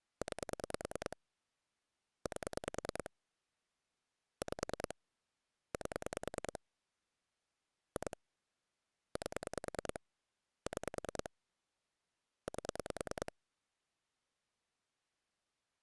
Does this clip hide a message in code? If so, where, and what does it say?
Yes: pulse dialling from 0.2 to 13.3 s, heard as clicks on a phone line, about 10 pulses a second. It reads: 9 8 5 8 2 8 6 8